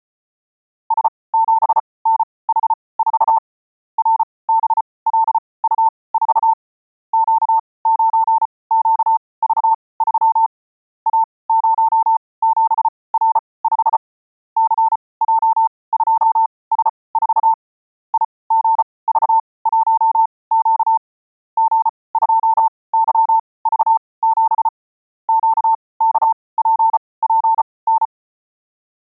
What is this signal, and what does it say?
Morse code, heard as a keyed tone, machine-sent, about 34 wpm, spaced as for 22 wpm, 900 Hz. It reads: S7NH4 RBLU4 Q9QV3 A07R5 CJ2S4 IGV1Q G2YV7 QKPPN